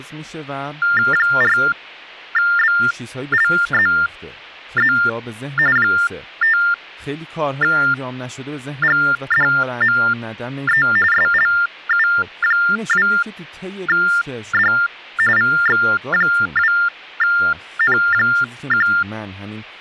TTY/TDD text telephone tones (45.45 baud Baudot), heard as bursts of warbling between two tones, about 400 Hz shift, 1600 Hz centre, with hum and speech in Persian. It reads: 4BLZZ 5GDME SLU2D VX2N1